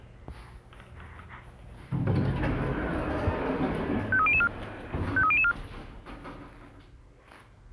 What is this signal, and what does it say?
Five-tone selective call (ZVEI), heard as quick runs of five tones, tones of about 70 ms, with the noise inside a lift. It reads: 53004 53004